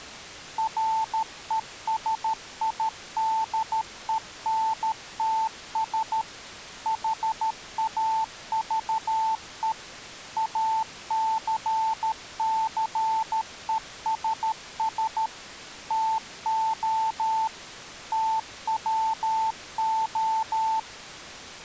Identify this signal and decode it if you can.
Morse code, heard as a keyed tone, machine-sent, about 13 wpm, 890 Hz. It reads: RESIDENTS HAVE ACCESS TO TWO